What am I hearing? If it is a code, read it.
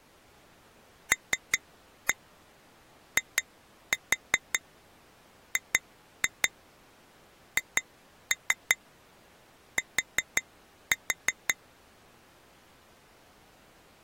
Tap code, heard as taps on glass, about 5 knocks a second. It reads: LIGHT